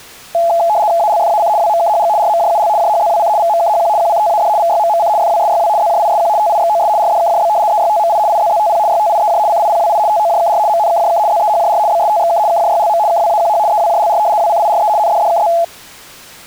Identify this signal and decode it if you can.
RTTY (75 baud, 170 Hz shift), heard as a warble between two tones, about 760 Hz centre. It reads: ALFAC WMKHG RMJUL JHZWC VMKHQ QCTAD VYMMC FWSYW ZJISQ TIXOS RDKJB EYTMI IZZTP YTIEJ CIPWI TOJKR MNKJK ZEHJR BSTXK KJYLM KWAQH EWJLR WCIRE NDDKZ